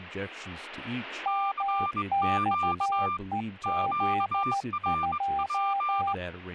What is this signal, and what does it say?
Morse code, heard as two keyed tones, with speech in English. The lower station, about 14 wpm, 790 Hz: MXEZ2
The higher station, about 21 wpm, 1190 Hz: CQ QRP